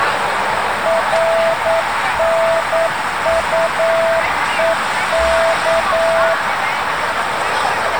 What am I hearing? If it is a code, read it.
Morse code, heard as a keyed tone, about 9 wpm, 660 Hz, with static crashes and street noise. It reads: RNUEK